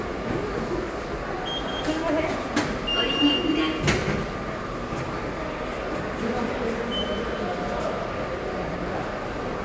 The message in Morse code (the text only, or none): none